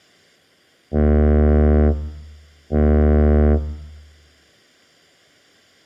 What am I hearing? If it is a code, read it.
Ship horn signal, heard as a ship's horn, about 80 Hz. 2 short. At sea: I am altering course to port.